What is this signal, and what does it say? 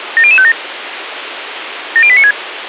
Five-tone selective call (ZVEI), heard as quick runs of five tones, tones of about 70 ms, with radio hiss. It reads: 70057 70896